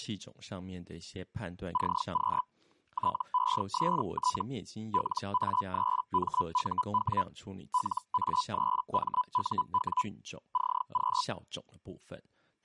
Hellschreiber (Feld-Hell, 122.5 baud), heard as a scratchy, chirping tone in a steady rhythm, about 1000 Hz, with speech in Chinese. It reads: CQ TEST LA3MUW LA3MUW CQ